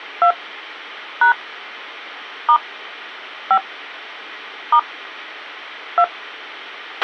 DTMF, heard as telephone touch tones, dialled by hand, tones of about 90 ms, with a squelch burst at the end. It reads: 2 # * 5 * 2